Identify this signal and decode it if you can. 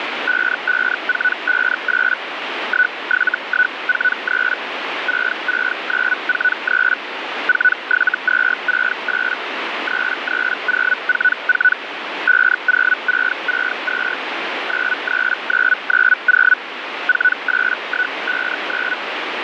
Hellschreiber (Feld-Hell, 122.5 baud), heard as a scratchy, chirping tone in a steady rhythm, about 1490 Hz, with radio static. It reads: 55458 17143 66943 47268 33044 50662 93990 48159